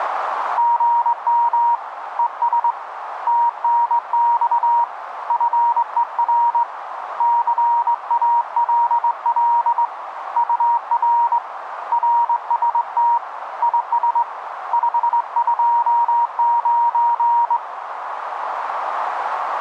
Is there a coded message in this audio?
Yes: Morse code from 0.5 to 17.6 s, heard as a keyed tone, hand-sent with a straight key, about 21 wpm, 940 Hz, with radio static and a narrow filter. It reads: GM ES TNX FER CALL UR RST IS 529